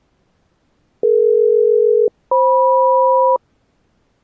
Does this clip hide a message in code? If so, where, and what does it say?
Yes: aircraft SELCAL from 1.0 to 3.4 s, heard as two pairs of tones. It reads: DE-FM